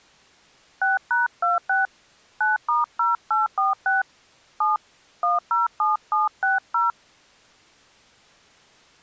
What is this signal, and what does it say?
DTMF, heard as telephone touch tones, dialled by hand, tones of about 160 ms. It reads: 6#26 9*0846 7 107760